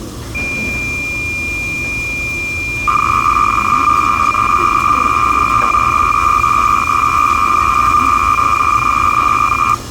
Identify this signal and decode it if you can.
Cassette data (Kansas City type), 300 baud, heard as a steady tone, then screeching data, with the noise of a restaurant.